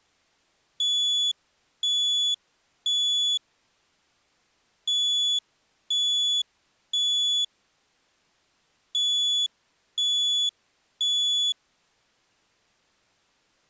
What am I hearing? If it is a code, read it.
Alarm pattern, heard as an alarm's beeps, played three times, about 3400 Hz. Temporal three. Smoke or fire, evacuate.